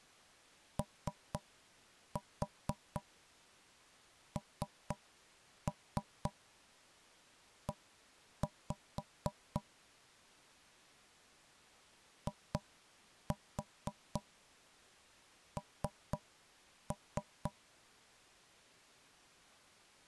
Tap code, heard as knocks on wood, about 4 knocks a second. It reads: ONE IN